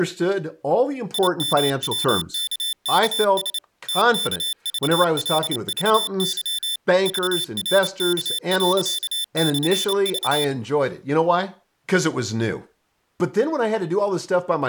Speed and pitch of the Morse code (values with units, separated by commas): 28 wpm, 3550 Hz